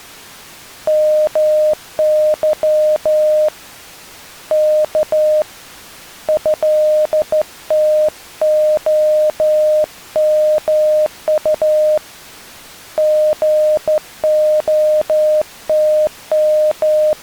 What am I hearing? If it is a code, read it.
Morse code (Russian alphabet), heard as a keyed tone, hand-sent with a straight key, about 13 wpm, 610 Hz. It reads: МЫ К ЭТОМУ …